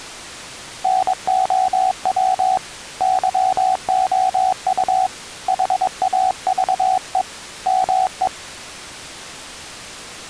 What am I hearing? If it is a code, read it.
Morse code, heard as a keyed tone, hand-sent with a paddle, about 22 wpm, 750 Hz. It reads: NOW YOU HAVE ME